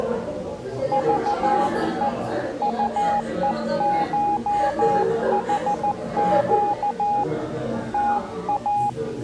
Morse code (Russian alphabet), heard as a keyed tone, hand-sent with a paddle, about 14 wpm, 820 Hz, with the noise of a crowd indoors. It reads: ЖЕ УЕШХЩ ТА